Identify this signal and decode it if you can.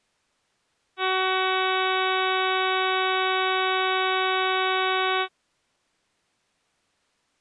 Ship horn signal, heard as a ship's horn, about 380 Hz. 1 long. At sea: a vessel nearing a blind bend, or under power and making way in fog.